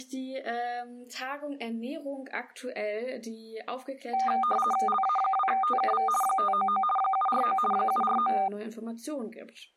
RTTY (50 baud, 450 Hz shift), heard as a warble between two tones, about 1000 Hz centre. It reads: LA2TKV 599 749 749